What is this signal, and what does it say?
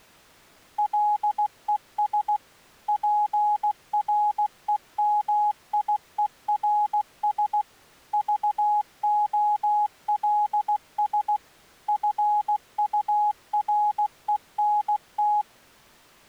Morse code, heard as a keyed tone, machine-sent, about 16 wpm, 840 Hz. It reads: LES PREMIERS VOLS FURENT